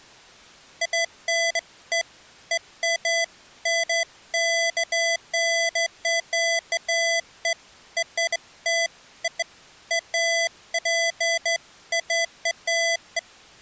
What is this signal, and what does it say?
Beeps of irregular length. There is no code.